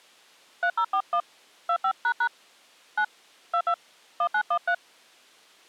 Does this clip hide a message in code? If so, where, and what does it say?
Yes: DTMF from 0.6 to 4.7 s, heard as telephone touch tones, dialled by hand, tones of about 70 ms. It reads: 3041 25## 9 22 1913